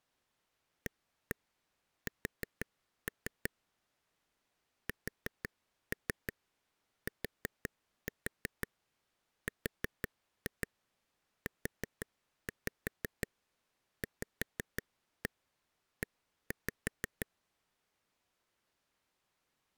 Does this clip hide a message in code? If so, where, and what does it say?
Yes: tap code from 0.9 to 17.2 s, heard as taps on a table, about 5 knocks a second. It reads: AS STRUVE